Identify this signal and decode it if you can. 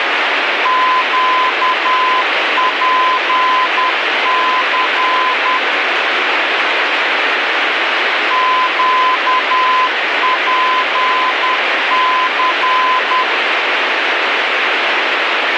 Morse code, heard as a keyed tone, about 10 wpm, 1020 Hz, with heavy radio static. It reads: QPC QPC